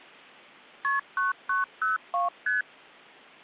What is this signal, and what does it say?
Multi-frequency trunk signalling (R1, as on North American trunks), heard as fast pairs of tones, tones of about 150 ms. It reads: KP 9902 ST